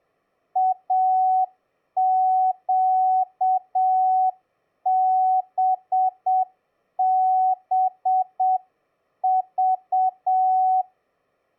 Morse code, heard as a keyed tone, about 7 wpm, 750 Hz. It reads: AQBBV